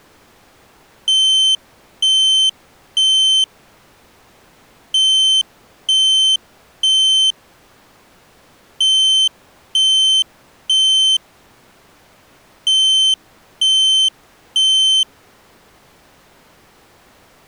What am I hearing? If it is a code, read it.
Alarm pattern, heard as an alarm's beeps, played four times, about 3100 Hz. Temporal three. Smoke or fire, evacuate.